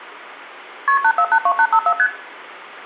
Multi-frequency trunk signalling (R1, as on North American trunks), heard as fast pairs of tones, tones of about 70 ms, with room echo. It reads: KP 8482854 ST